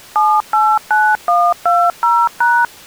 DTMF, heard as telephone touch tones, dialled by machine, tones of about 240 ms. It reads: 789120#